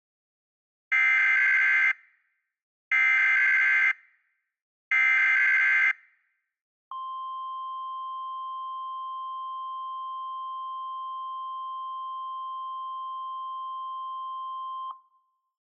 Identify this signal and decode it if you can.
Emergency Alert System (SAME) tones (header bursts, then the 1050 Hz attention tone), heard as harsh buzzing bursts, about 520.83 baud.